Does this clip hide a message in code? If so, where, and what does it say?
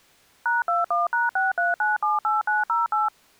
Yes: DTMF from 0.5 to 3.1 s, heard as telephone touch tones, dialled by machine, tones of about 160 ms. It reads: #21#63978908